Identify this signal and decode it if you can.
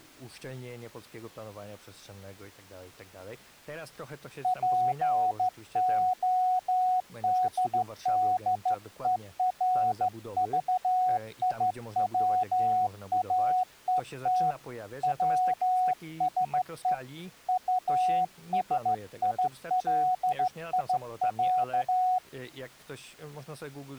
Morse code (Russian alphabet), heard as a keyed tone, hand-sent with a straight key, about 14 wpm, 740 Hz, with speech in Polish. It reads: ПОДДЕРЖИВАЕТ ВСЕ УСИЛИЯ